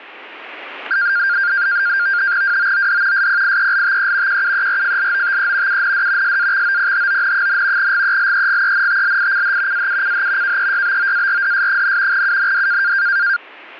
NAVTEX (SITOR-B), 100 baud, 170 Hz shift, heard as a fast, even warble, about 1500 Hz centre. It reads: WOOD SPIELTE QUERFLOTE UND SAXOPHON, GELEGENTLICH AUCH KEYBOARDS, UND